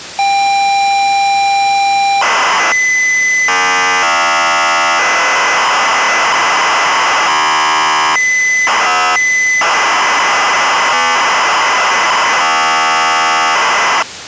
ZX Spectrum tape loading, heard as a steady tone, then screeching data.